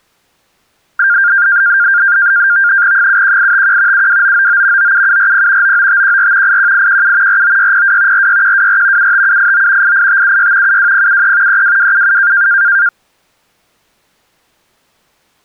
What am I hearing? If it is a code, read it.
NAVTEX (SITOR-B), 100 baud, 170 Hz shift, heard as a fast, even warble, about 1500 Hz centre. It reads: 71851 72999 97740 99514 81817 49602 46124 75789 88576 72073 32277